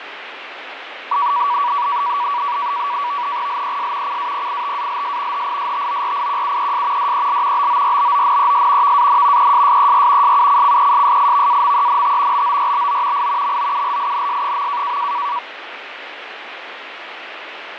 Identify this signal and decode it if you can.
NAVTEX (SITOR-B), 100 baud, 170 Hz shift, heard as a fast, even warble, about 1050 Hz centre, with radio static and fading. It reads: LES CAPITALS HISTORIQUES DEL BORBONES VAN ESSER SUCCESSIVAMENT BORBO I MOULINS.